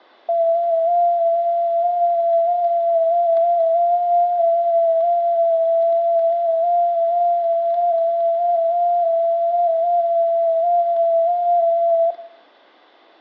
FT8 (one signal), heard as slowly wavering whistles, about 6.25 baud, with static crashes and room echo.